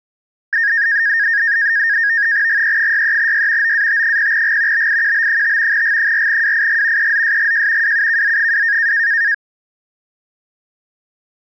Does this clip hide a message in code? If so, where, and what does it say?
Yes: NAVTEX (SITOR-B), 100 baud, 170 Hz shift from 0.5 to 9.3 s, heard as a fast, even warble, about 1750 Hz centre. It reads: GE63Y OAT0G BIQB5 G4WIG EZSGJ WUKZ2